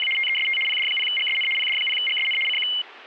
RTTY (75 baud, 850 Hz shift), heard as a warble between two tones, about 2550 Hz centre. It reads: … TEST PD0GSN PD0GSN CQ